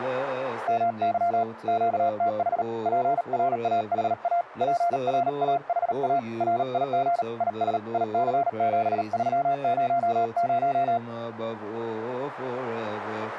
Morse code, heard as a keyed tone, hand-sent with a paddle, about 38 wpm, 690 Hz. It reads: MY QTH PRAHA PRAHA RIG IS IC7300